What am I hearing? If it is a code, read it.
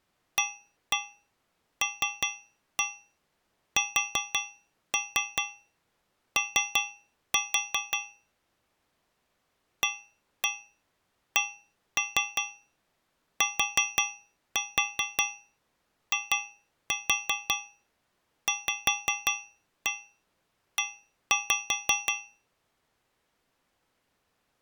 Tap code, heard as taps on a metal pipe, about 5 knocks a second. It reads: ALSO ACTIVE